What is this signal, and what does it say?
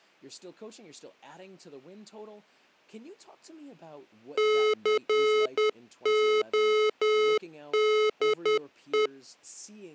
Morse code, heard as electronic beeps, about 10 wpm, 430 Hz, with speech in English. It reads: CODE